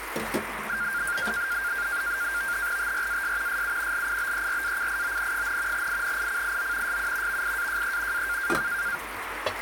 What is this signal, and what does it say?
NAVTEX (SITOR-B), 100 baud, 170 Hz shift, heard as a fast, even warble, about 1500 Hz centre, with radio static and kitchen noise. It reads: TRAS SU LIBERACION, INICIO SU VIAJE A